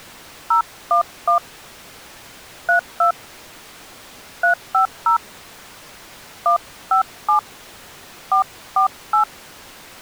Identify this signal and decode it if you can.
DTMF, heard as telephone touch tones, dialled by hand, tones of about 110 ms. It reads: 011 32 350 157 448